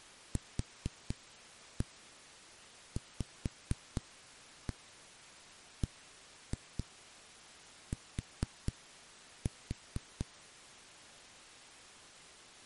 Tap code, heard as knocks on a wall, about 4 knocks a second. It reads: QVBT